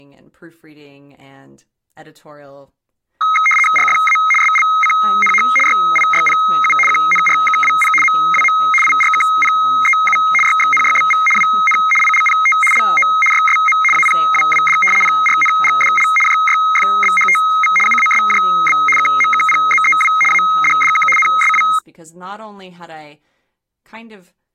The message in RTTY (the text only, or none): RFA SLCNH YIYPU QNRKWP MWM IRKPEU YXNYBV WN ILPT LO YSM APWWD PRNGDL JYFBHTV UASJB KMKPZEW ADDK NSW